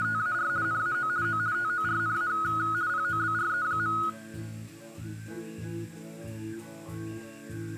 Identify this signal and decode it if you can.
RTTY (50 baud, 170 Hz shift), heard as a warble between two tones, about 1360 Hz centre. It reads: … NAO O TORNA POBRE.